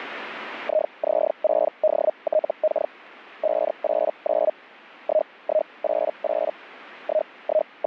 Hellschreiber (Feld-Hell, 122.5 baud), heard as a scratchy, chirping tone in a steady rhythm, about 620 Hz. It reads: IZ6DTK 589 1188 …